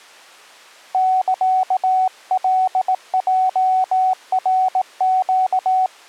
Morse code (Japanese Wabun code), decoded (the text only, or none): サカヲナネ